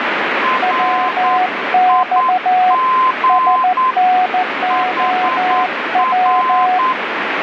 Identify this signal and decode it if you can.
Morse code, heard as two keyed tones, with radio static. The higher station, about 9 wpm, 1030 Hz: RIG HR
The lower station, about 14 wpm, 740 Hz: WX SNOW